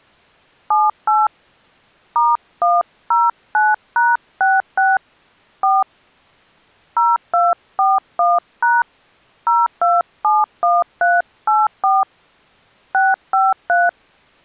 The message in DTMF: 78 *109#66 4 0241# 0271384 653

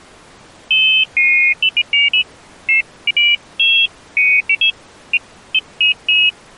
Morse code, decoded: none

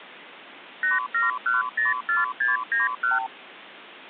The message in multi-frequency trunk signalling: 87104691

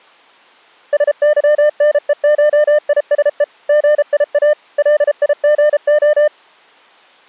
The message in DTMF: none

